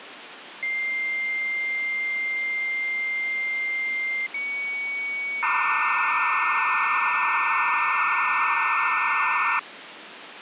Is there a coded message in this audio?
Yes: dial-up modem handshake (low-speed, two carriers) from 0.6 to 9.6 s, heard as two whistles, then hiss, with phone line noise.